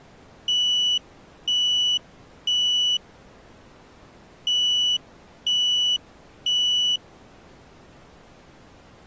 Alarm pattern, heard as an alarm's beeps, played twice, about 2950 Hz. Temporal three. Smoke or fire, evacuate.